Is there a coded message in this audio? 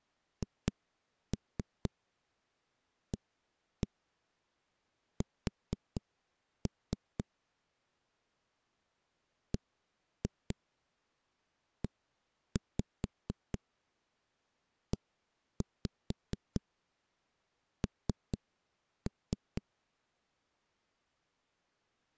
Yes: tap code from 0.4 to 19.6 s, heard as knocks on a wall, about 4 knocks a second. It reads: HAS BEEN